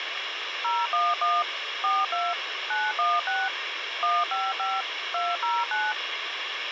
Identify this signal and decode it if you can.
DTMF, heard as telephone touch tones, dialled by machine, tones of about 210 ms, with radio hiss. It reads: 011 42 916 155 209